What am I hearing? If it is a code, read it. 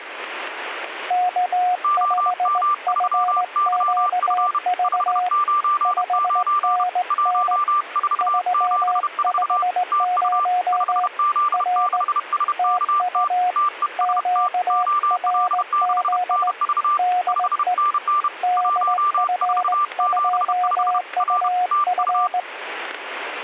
Morse code, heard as two keyed tones, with radio static and static crashes. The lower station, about 18 wpm, 720 Hz: K5FQV 5NN 350 R TU QRZ DE DF2UF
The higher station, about 31 wpm, 1180 Hz: OM3YF 599 1474 TU 5Z6SKT TEST OL6NV 5NN 1475 R TU